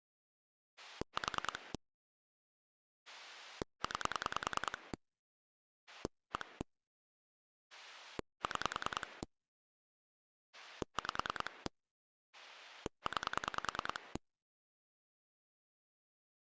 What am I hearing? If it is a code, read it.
Pulse dialling, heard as a rotary dial, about 10 pulses a second. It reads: 4 9 1 6 5 9